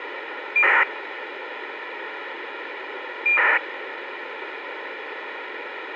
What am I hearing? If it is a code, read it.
ACARS aircraft data, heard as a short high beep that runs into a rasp, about 2400 baud, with radio hiss.